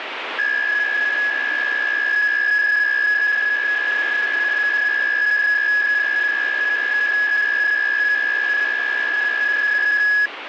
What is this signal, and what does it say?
PSK63 (62.5 baud), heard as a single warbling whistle, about 1700 Hz, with radio static.